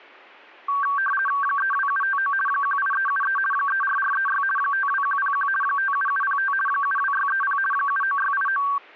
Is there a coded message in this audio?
Yes: RTTY (50 baud, 450 Hz shift) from 0.7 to 8.8 s, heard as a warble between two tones, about 1350 Hz centre. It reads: 32759 18373 34436 52101 57705 72630 79689